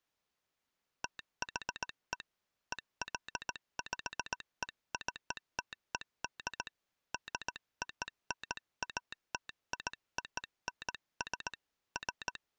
Morse code (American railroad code), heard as a telegraph sounder, hand-sent with a straight key. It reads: THE EXPECTED DONATIONS …